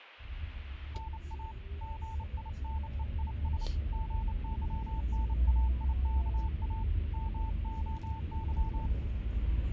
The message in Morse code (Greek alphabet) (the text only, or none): ΝΑ ΓΙΝΕΙΣ ΓΥΝΑΙΚΑ ΜΟΥ